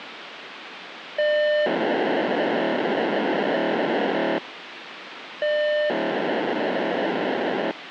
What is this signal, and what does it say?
POCSAG pager data (1200 baud), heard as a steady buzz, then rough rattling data, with radio hiss.